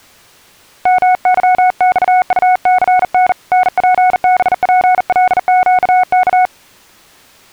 Morse code, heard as a keyed tone, hand-sent with a bug key, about 40 wpm, 740 Hz. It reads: MYXUCN NPBPLQK